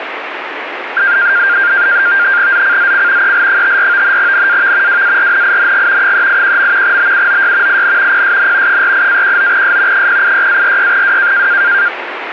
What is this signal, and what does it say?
NAVTEX (SITOR-B), 100 baud, 170 Hz shift, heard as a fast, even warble, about 1500 Hz centre, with radio static. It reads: ZCZC EL54 NAV WARNING 381. BUOY IN PSN 48-19S 086-46W